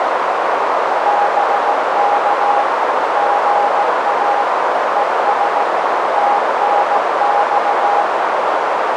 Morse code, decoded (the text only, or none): BK GA ES TNX